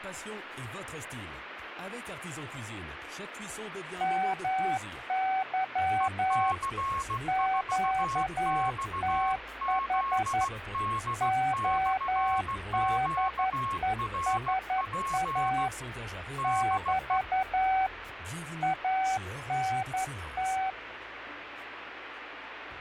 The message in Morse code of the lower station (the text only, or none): MY QTH ODESA <BT> ANT